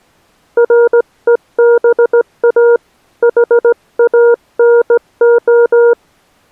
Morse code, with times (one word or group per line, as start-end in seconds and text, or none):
0.6-2.8 REBA
3.2-5.9 HANO